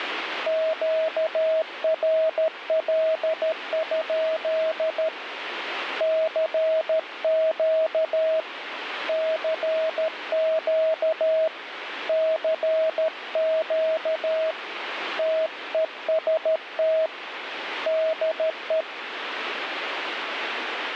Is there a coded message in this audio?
Yes: Morse code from 0.4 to 18.9 s, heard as a keyed tone, hand-sent with a paddle, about 13 wpm, 640 Hz, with radio static. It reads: QRL? CQ CQ CQ TEST DE